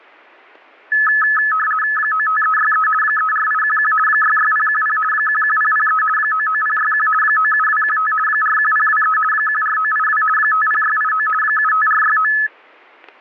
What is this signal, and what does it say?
RTTY (50 baud, 450 Hz shift), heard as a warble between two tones, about 1500 Hz centre, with static crashes. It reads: 95363 34811 66010 11003 99061 97215 41023 14982 50689 75469